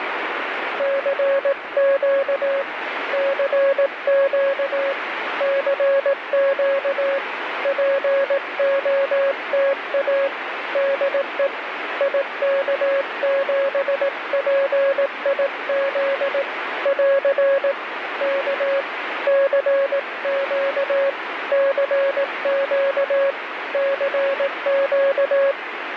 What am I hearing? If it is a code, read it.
Morse code, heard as a keyed tone, hand-sent with a paddle, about 18 wpm, 550 Hz, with radio static. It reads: CQ CQ CQ POTA DE IK7PIZ <AR> K CQ CQ CQ